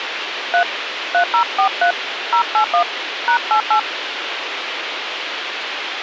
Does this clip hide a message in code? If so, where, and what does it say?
Yes: DTMF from 0.5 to 3.8 s, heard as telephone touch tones, dialled by hand, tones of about 90 ms, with radio hiss. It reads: 3 3043 081 #88